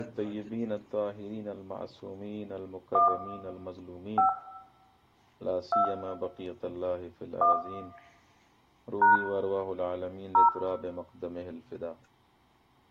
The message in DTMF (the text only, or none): 1 5 2 1 # 0